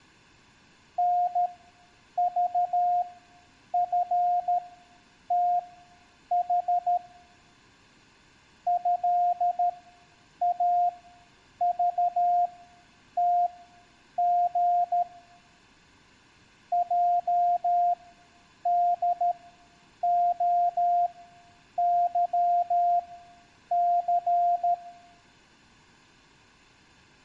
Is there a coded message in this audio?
Yes: Morse code (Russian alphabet) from 0.9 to 24.8 s, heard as a keyed tone, machine-sent, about 13 wpm, spaced as for 8 wpm, 700 Hz, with room echo. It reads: НЖФТХ ЭАЖТГ ЙДОЫЦ